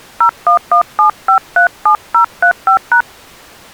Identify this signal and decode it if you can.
DTMF, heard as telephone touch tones, dialled by hand, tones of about 100 ms. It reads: 0117537035#